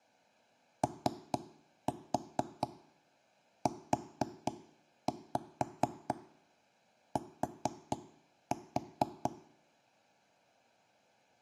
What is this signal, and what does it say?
Tap code, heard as knocks on wood, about 4 knocks a second. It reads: OUT